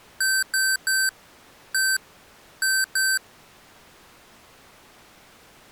Beep code, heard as beeps from a small speaker, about 1550 Hz. 3-1-2. In Phoenix BIOS tables: DMA register failure.